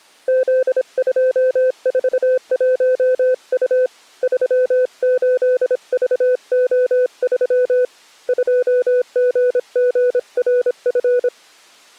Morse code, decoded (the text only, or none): Z241U 38VO3 2GGRF